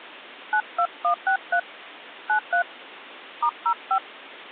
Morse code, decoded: none

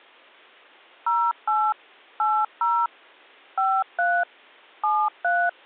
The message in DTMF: 08 80 53 73

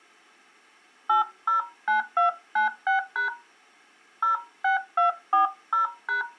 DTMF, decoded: 809296# 06240#

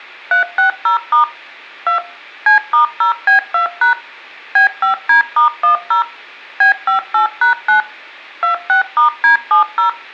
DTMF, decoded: 360* 2 C*0B2# B5D*10 B58#9 26*D70

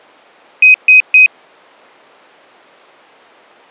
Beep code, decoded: 3 short

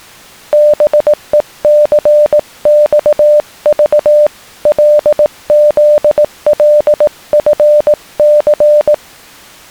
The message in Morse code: BECXV LZLFC

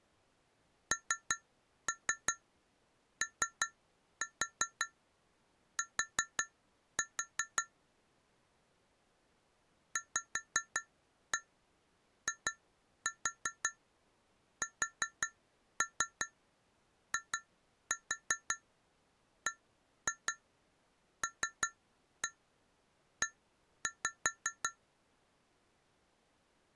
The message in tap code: NOT VISIBLE

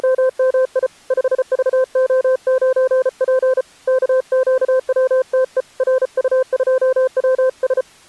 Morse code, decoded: … 5VO9P KQWTE RU2WS

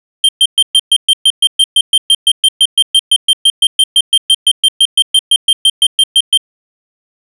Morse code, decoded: none

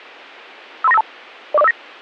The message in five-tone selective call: 53952 04059

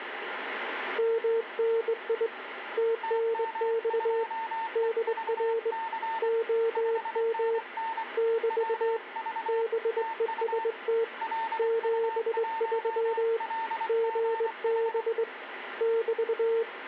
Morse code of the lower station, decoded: MNI TNX DR OM <BT> BEST 73 GB <BT>

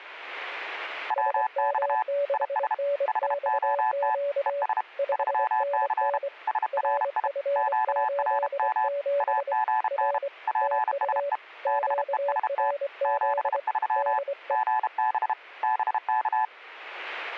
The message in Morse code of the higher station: WX IS HOT ES 3C SRI QRM AGN PSE BEST 73 GB BK

